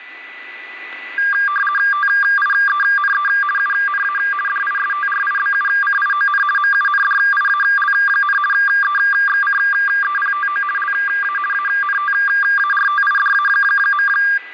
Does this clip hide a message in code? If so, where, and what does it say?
Yes: RTTY (50 baud, 450 Hz shift) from 1.2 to 14.4 s, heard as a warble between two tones, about 1400 Hz centre, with radio static and a steady whistle near 1990 Hz. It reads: TIENE UNA DISTRIBUCION MUNDIAL, EXCEPTO LA ANTARTIDA.